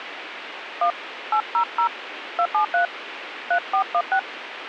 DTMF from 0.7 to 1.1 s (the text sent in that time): 1